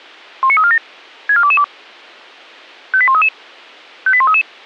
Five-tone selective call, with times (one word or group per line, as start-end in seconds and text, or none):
0.4-0.8 19347
1.3-1.6 64222
2.9-3.3 58133
4.1-4.4 58133